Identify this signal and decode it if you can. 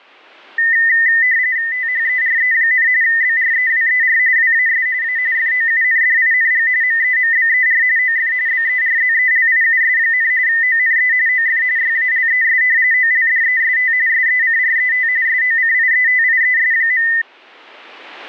RTTY (45.45 baud, 170 Hz shift), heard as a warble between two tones, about 1900 Hz centre. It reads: THERE, BREWER WAS A FOUNDING MEMBER OF BERZELIUS, ONE OF YALES OLDEST SECRET SOCIETIES.